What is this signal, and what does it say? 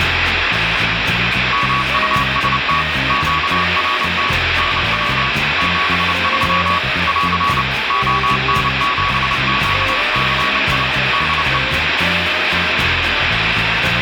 Morse code, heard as a keyed tone, machine-sent, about 29 wpm, 1130 Hz, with heavy radio static. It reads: MUST QRT NW 73 <AR> ON7QCI DE